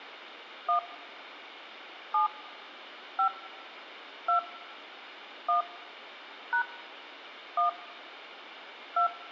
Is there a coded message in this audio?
Yes: DTMF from 0.7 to 9.1 s, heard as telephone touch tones, dialled by hand, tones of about 110 ms. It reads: 1 7 5 2 1 # 1 2